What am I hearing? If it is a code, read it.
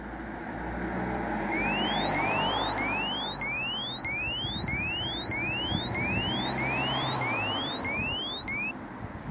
A tone that sweeps in pitch again and again, with street noise. There is no code.